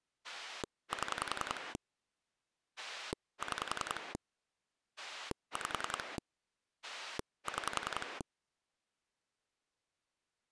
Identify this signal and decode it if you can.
Pulse dialling, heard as a rotary dial, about 10 pulses a second. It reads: 7 6 5 6